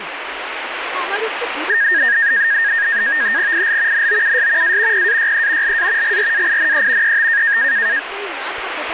NAVTEX (SITOR-B), 100 baud, 170 Hz shift, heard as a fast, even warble, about 1750 Hz centre, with radio static and speech in Bangla. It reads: IL NOUS A PAYE LA GRAINE ET